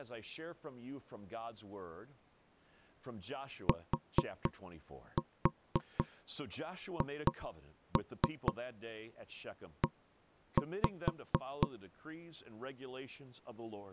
Tap code, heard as knocks on wood, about 4 knocks a second, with speech in English. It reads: THE